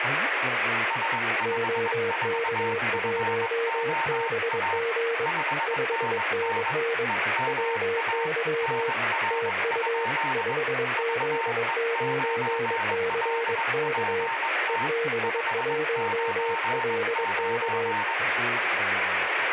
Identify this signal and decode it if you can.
Morse code, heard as two keyed tones, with radio static and speech in English. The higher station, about 21 wpm, 910 Hz: S54FOA 5NN EMA NR? VE9LPT 599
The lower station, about 22 wpm, 460 Hz: OK1BG 5NN WY TU 5Z9CK EB1LK